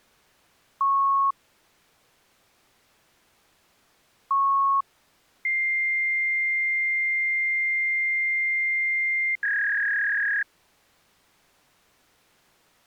Fax machine handshake, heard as beeps, a long tone and a warble.